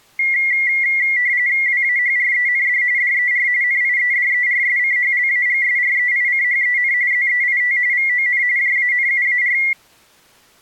RTTY (45.45 baud, 170 Hz shift), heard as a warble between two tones, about 2050 Hz centre. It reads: WAHREND DER NIEDERSCHLAGSREICHEN ZEIT VON JANUAR